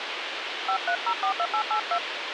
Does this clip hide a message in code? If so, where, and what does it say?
Yes: DTMF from 0.7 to 2.0 s, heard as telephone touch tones, dialled by hand, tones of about 80 ms, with radio hiss. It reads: 53042882